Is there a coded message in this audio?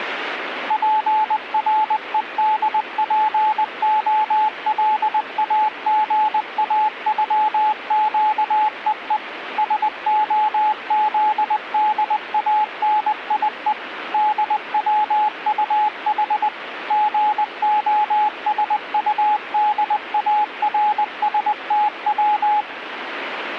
Yes: Morse code (Russian alphabet) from 0.6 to 22.7 s, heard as a keyed tone, machine-sent, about 20 wpm, 850 Hz, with radio static. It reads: ПРЕДПОЛАГАЮЩЕЕ СОЗДАНИЕ ДВУХ ГОСУДАРСТВ